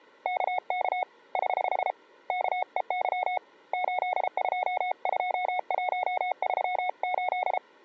Morse code, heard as a keyed tone, hand-sent with a paddle, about 33 wpm, 730 Hz. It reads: KK <HH> KEY 822138